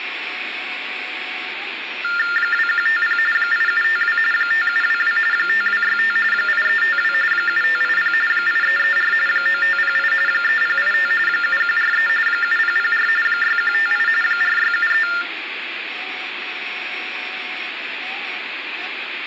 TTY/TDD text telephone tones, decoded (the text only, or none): 2150 8752 5722 5265 8352 7580 8334 9508 3085 7143 7004 6158 4673